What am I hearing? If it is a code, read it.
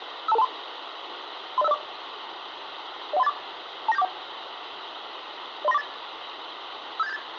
Five-tone selective call (EIA), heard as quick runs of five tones, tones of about 30 ms, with radio hiss. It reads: 52223 30504 01384 29741 03948 57878